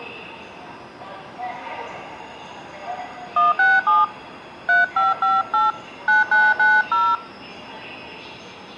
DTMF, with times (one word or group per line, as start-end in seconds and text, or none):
3.4-4.0 167
4.7-5.7 3558
6.1-7.2 9990